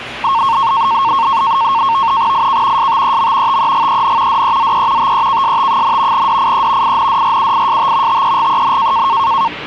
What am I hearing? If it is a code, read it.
NAVTEX (SITOR-B), 100 baud, 170 Hz shift, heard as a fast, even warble, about 1000 Hz centre, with the noise of a cafe. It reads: IK STEM TEGEN DEZE TEKST, DIE INDRUIST TEGEN